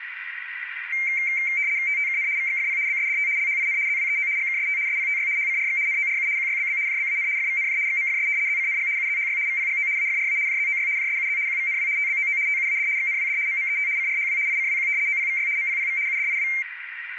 RTTY (75 baud, 170 Hz shift), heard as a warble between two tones, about 2200 Hz centre, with radio static and a narrow filter. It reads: TTKN VXFP BSDT LHIN ZWEO GKST SPTY HCRX NORU QYBB JBAN FVNJ XMFS ZCNG UZHY VPGO AFRA JZOY JSUZ QVNW TBOO TUAD XNWD MMET CRHW ICWQ OPVY MPPV UDIW